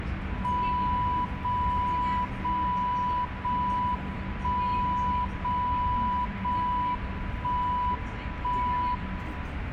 Radio time signal (JJY), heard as a tone whose level steps once a second, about 990 Hz, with radio static and the noise inside a bus. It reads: 0 0 0 1 0 0 1 1 1